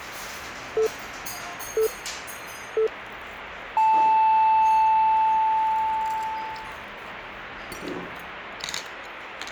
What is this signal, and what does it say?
Radio time signal (three low pips and a long one an octave up, as on NHK), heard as pips, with the noise of a restaurant.